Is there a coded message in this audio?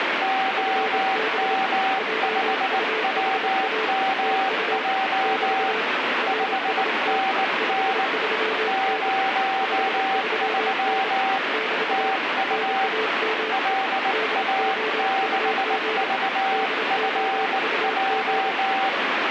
Yes: Morse code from 0.2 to 19.0 s, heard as two keyed tones, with heavy radio static. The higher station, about 19 wpm, 770 Hz: OM5WMJ 5NN 03 TU LA6VFJ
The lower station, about 27 wpm, 440 Hz: FB JUHA TU <BT> RST 53N 53N <BT> NAME DOUG DOUG